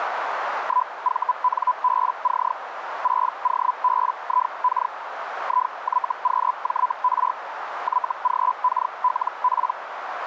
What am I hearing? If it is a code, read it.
Hellschreiber (Feld-Hell, 122.5 baud), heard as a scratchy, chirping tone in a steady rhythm, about 1000 Hz, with radio static and a narrow filter. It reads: 1VNBC 6OBIK IYQJR YGKLP